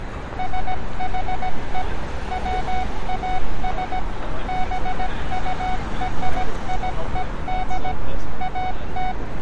Morse code (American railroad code), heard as a keyed tone, machine-sent, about 740 Hz, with street noise. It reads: SHE WAS BURIED AT